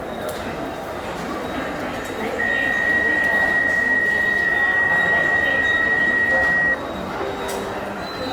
PSK63 (62.5 baud), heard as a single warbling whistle, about 1900 Hz, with the noise of a subway station.